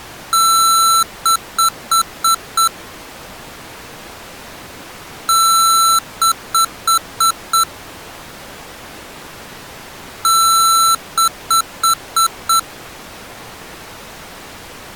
Beep code, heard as beeps from a small speaker, played three times, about 1340 Hz. 1 long, 5 short.